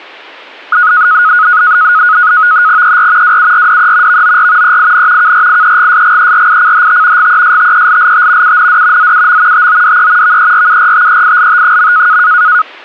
NAVTEX (SITOR-B), 100 baud, 170 Hz shift, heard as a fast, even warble, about 1360 Hz centre. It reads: ER WURDE VOR EIN KRIEGSGERICHT GESTELLT UND ZUM TODE VERURTEILT.